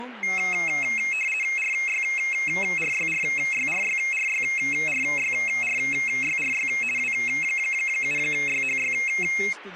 RTTY (50 baud, 450 Hz shift), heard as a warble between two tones, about 2350 Hz centre, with radio static and speech in Portuguese. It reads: RYRYRYRYRYRYRYRY W7YHY